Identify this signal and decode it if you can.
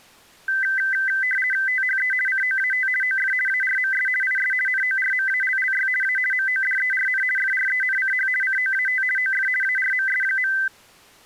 RTTY (50 baud, 450 Hz shift), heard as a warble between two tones, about 1800 Hz centre. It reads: THE COAT OF ARMS IS NORMALLY A MODERN FRENCH COAT OF ARMS.